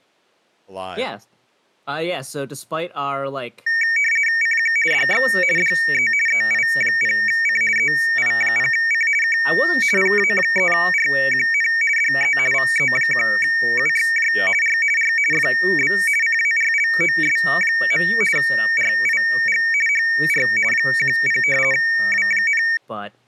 RTTY (50 baud, 450 Hz shift), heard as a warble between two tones, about 2050 Hz centre, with speech in English. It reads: CQ DX DE EI0C EI0C K PA3RQN DE VE1UXJ R R FB CARLOS. RIG HR 10 W,